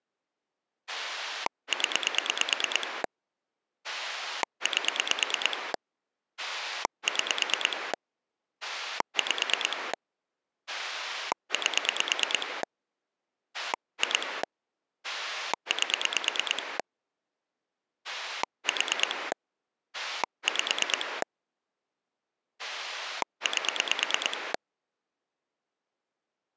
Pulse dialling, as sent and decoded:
10 / 8 / 6 / 5 / 8 / 2 / 8 / 4 / 5 / 8
0 8 6 5 8 2 8 4 5 8

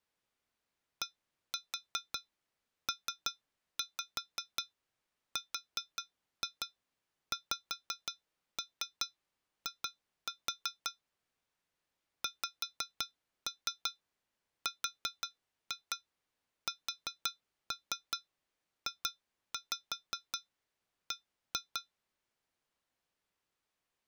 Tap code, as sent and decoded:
1-4 3-5 4-2 5-3 2-4 / 5-3 4-2 4-3 2-5 1-2
DPRXI XRSJB

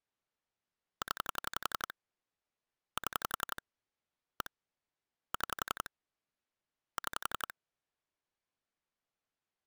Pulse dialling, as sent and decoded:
10 / 7 / 1 / 6 / 6
0 7 1 6 6

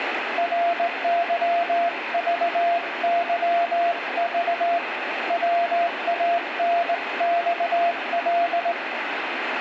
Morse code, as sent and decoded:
.-. -.-- ...- -.-- ...- / .-- .- -. -..- .-..
RYVYV WANXL

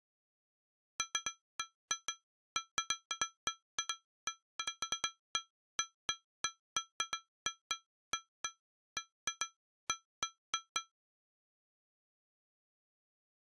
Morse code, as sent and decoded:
none

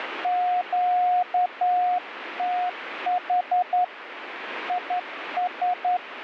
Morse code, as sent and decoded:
--.- - .... / .. ...
QTH IS

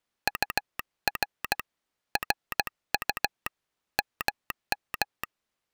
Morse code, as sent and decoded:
..- .-. / .-. ..- / -- --
UR RU MM

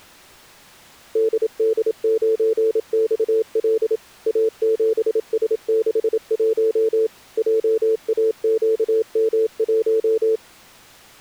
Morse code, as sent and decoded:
-.. -.. ----. -..- .-.. / .- --... ... -.... .---- / .--- .- --.- -- .----
DD9XL A7S61 JAQM1

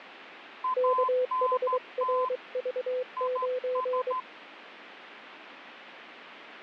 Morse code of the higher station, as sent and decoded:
.- -. - / .. ...
ANT IS

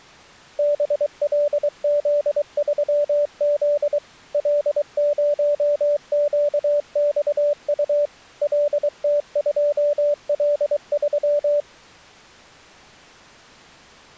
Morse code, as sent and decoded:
-... .-.. --.. ...-- --.. / .-.. ----- --.- -..- ..- / .-.. - ..--- .-.. ...--
BLZ3Z L0QXU LT2L3

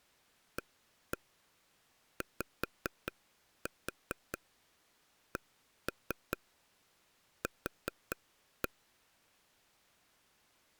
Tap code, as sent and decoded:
1-1 5-4 1-3 4-1
AYCQ

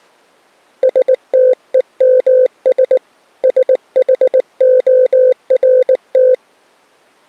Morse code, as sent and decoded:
... - . -- ... / ... .... --- .-. -
STEMS SHORT

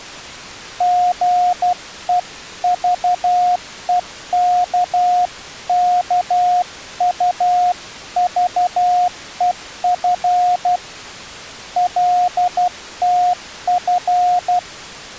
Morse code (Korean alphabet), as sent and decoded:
--. . ...- . -.- -.- ..- ...- . ..-. / .-.. - ..-.
사랑이란 건

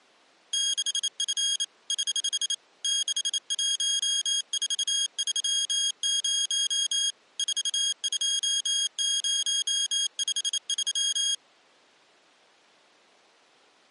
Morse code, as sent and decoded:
-.... ..-. / ........ / -.... .---- ....- ...-- ----- / ....- ..--- ----- ..... ...--
6F <HH> 61430 42053

